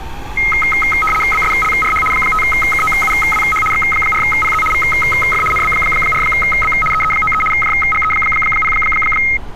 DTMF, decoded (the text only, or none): none